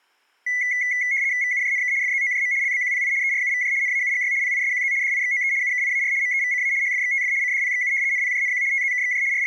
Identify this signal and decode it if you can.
RTTY (75 baud, 170 Hz shift), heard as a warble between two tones, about 2050 Hz centre. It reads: VUJNK FZOJM LBQPI ERUVJ NAUGY PISQZ DIXOE UKIAR MEVCA HFXTF CDPXU NPJNQ TZKXJ …